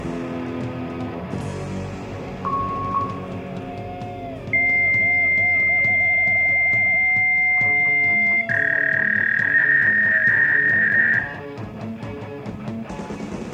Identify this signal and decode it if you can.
Fax machine handshake, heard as a beep, a long tone and a warble, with room echo.